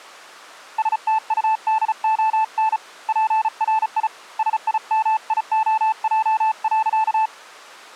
Morse code, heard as a keyed tone, hand-sent with a paddle, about 35 wpm, 880 Hz. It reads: STUDON PRI SIMIOJ.